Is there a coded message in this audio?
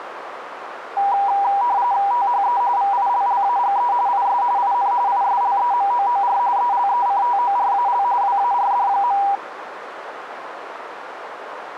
Yes: RTTY (45.45 baud, 170 Hz shift) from 1.0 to 9.4 s, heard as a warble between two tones, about 880 Hz centre, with radio static and a narrow filter. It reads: THE VILLAGE IS IN ISLEMOOR ELECTORAL WARD.